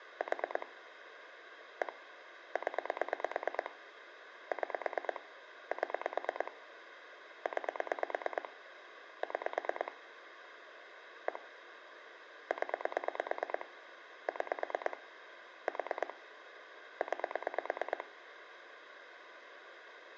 Pulse dialling, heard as clicks on a phone line, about 9 pulses a second, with phone line noise and room echo. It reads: 4 1 0 6 7 9 6 1 0 6 4 9